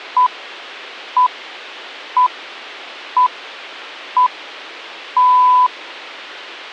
Radio time signal (six pips, as the Greenwich Time Signal), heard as pips.